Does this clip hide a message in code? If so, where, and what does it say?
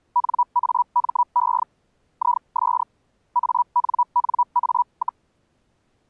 Yes: Hellschreiber (Feld-Hell, 122.5 baud) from 0.2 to 5.2 s, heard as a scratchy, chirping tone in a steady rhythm, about 970 Hz. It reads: NAME IS ANNA,